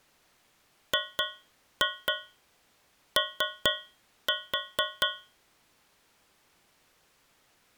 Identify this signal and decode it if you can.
Tap code, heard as taps on a metal pipe, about 4 knocks a second. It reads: GO